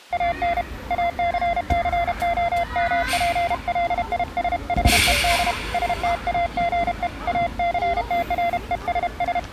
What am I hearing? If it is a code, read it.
Morse code, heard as a keyed tone, hand-sent with a paddle, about 32 wpm, 690 Hz, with the noise of a park. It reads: AN ACCOMPLISHED STAGE ACTRESS